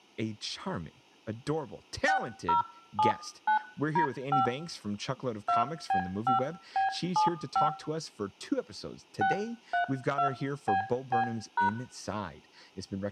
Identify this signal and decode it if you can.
DTMF, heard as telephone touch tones, dialled by hand, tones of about 120 ms, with room echo and speech in English. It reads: 6079D5 2B5B75 632BB#